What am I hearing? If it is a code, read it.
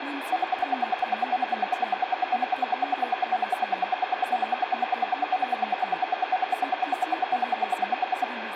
Radio time signal (RWM, Moscow), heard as ten pulses a second, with radio static, room echo and speech in Bodo.